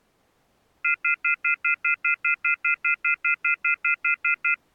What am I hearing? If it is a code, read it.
Telephone call progress tone (North American plan), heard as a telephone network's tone, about 1400, 2050, 2450, 2600 Hz, 0.1 s on and 0.1 s off. Off-hook warning tone.